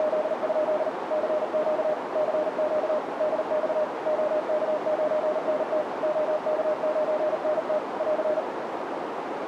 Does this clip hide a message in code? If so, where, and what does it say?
Yes: Morse code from 0.0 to 8.5 s, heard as a keyed tone, machine-sent, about 39 wpm, 610 Hz, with radio static and a narrow filter. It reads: … CQ CQ DX OK9NT OK9NT <AR>